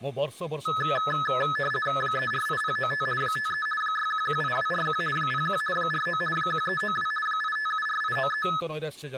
RTTY (50 baud, 450 Hz shift), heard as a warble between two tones, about 1500 Hz centre, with speech in Odia. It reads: 348095 53 6118241 01 49 1392 8574893